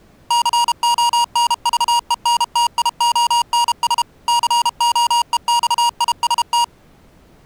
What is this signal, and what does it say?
Morse code, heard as electronic beeps, machine-sent, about 32 wpm, 950 Hz. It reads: CONVENTIONS COEXIST